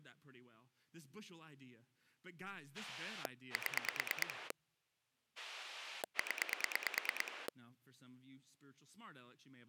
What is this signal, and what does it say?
Pulse dialling, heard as a rotary dial, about 9 pulses a second, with speech in English. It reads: 7 0